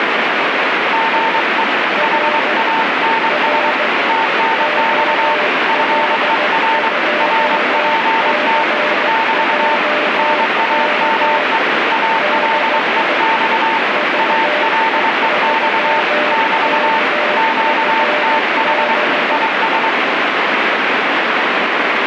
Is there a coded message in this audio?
Yes: Morse code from 0.9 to 20.0 s, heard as two keyed tones, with heavy radio static. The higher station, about 23 wpm, 900 Hz: GE HANS TNX FER RPT <BT> NAME ALEX ALEX <BT> QTH IS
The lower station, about 15 wpm, 600 Hz: R R OL2CJK DE VE3KFB